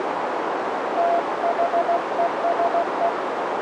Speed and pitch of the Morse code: 16 wpm, 680 Hz

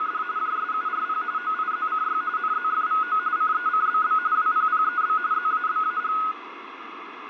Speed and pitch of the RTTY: 45.45 baud, 170 Hz shift, 1360 Hz centre

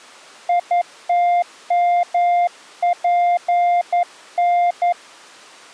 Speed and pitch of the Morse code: 11 wpm, 700 Hz

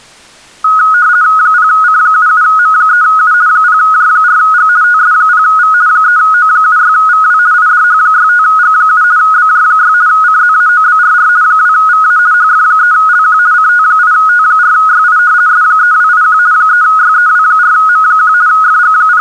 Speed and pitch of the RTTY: 50 baud, 170 Hz shift, 1360 Hz centre

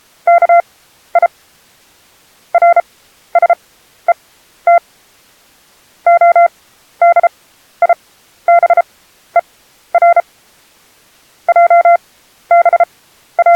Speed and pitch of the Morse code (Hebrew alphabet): 33 wpm, spaced as for 13 wpm, 690 Hz

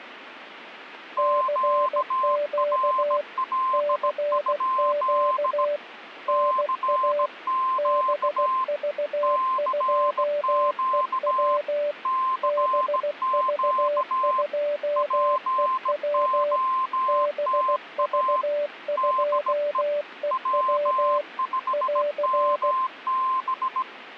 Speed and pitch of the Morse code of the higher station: 17 wpm, 1040 Hz

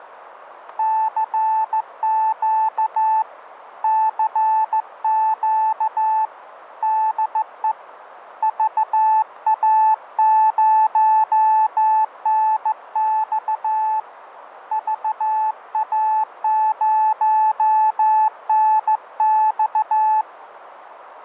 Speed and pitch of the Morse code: 15 wpm, 870 Hz

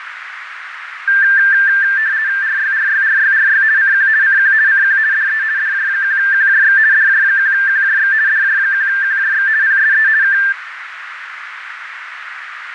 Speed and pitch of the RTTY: 50 baud, 170 Hz shift, 1700 Hz centre

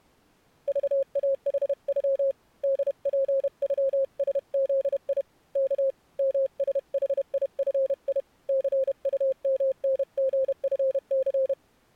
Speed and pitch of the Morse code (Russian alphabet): 31 wpm, 530 Hz

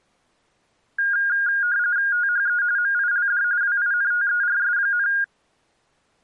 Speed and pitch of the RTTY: 45.45 baud, 170 Hz shift, 1550 Hz centre

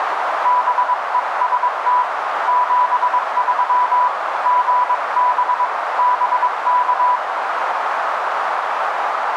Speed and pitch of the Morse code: 22 wpm, 990 Hz

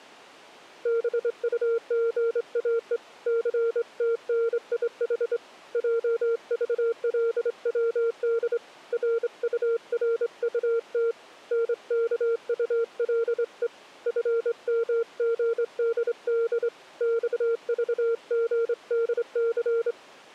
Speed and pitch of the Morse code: 25 wpm, 460 Hz

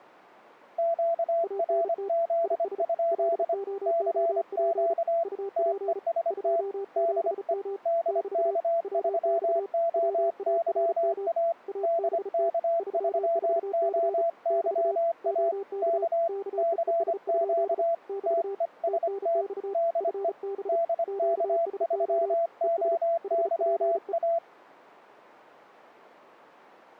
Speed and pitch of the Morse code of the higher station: 25 wpm, 670 Hz

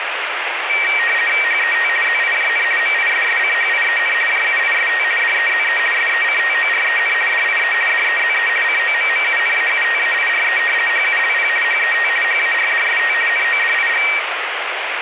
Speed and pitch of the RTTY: 50 baud, 450 Hz shift, 2100 Hz centre

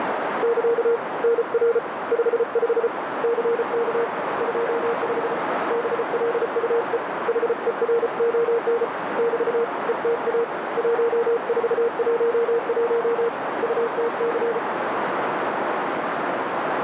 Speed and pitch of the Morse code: 34 wpm, 470 Hz

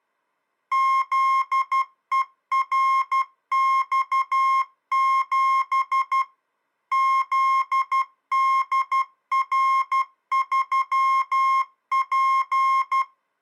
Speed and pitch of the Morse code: 12 wpm, 1070 Hz

